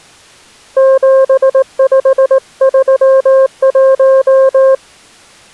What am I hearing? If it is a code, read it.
Morse code, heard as a keyed tone, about 18 wpm, 530 Hz. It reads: 7531